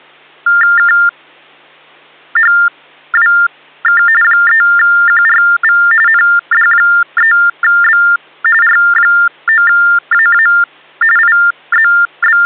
TTY/TDD text telephone tones (45.45 baud Baudot), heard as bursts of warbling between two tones, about 400 Hz shift, 1600 Hz centre. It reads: KHWK 3QRV ND3B R9AA …